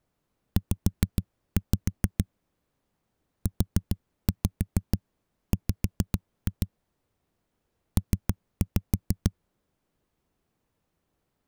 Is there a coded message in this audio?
Yes: tap code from 0.6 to 9.3 s, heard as knocks on a wall, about 6 knocks a second. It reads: Z UW P